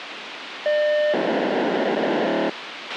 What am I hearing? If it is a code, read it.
POCSAG pager data (1200 baud), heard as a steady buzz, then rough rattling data, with radio hiss and a squelch burst at the end.